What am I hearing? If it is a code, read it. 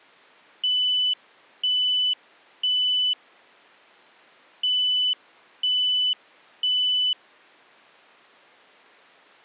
Alarm pattern, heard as an alarm's beeps, played twice, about 3000 Hz. Temporal three. Smoke or fire, evacuate.